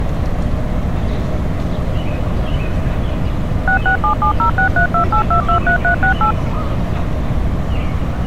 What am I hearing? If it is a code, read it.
DTMF, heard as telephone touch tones, dialled by machine, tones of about 100 ms, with street noise. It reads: 667706328223368